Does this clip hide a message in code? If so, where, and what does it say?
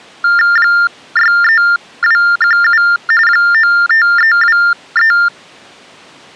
Yes: TTY/TDD text telephone tones (45.45 baud Baudot) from 0.2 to 5.3 s, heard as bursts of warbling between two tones, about 400 Hz shift, 1600 Hz centre. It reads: 63217 95323